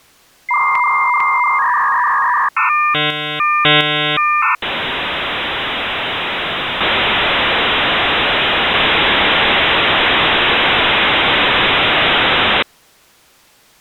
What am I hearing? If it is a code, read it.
Dial-up modem handshake (V.34 or later), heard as a whistle, warbles, then hiss.